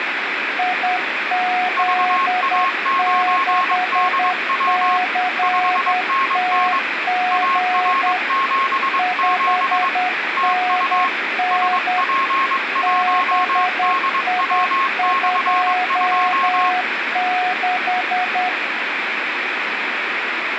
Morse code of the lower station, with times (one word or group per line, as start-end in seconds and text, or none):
0.6-8.2 IZ6CTG
9.0-12.0 5NN
12.8-18.5 BI26